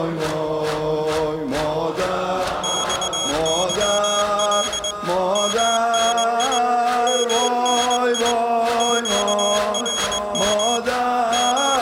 Morse code, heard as a high beeper, hand-sent with a straight key, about 21 wpm, 3300 Hz. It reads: XYL MNI MNI QRM …